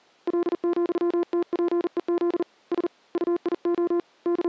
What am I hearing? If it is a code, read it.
Morse code, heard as a keyed tone, hand-sent with a paddle, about 40 wpm, 350 Hz. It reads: L,TPEZ S UIO …